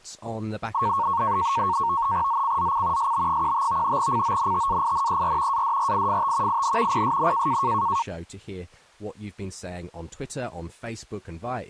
NAVTEX (SITOR-B), 100 baud, 170 Hz shift, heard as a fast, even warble, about 1010 Hz centre. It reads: ZCZC SB15 CONTAINER ADRIFT IN PSN